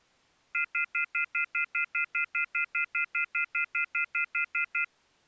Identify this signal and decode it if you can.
Telephone call progress tone (North American plan), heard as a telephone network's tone, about 1400, 2050, 2450, 2600 Hz, 0.1 s on and 0.1 s off. Off-hook warning tone.